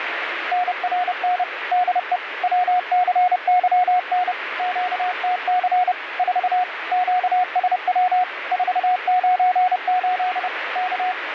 Morse code, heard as a keyed tone, machine-sent, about 30 wpm, 730 Hz, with radio static. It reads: NRN DE WCYN QTC 4 QSW 498 K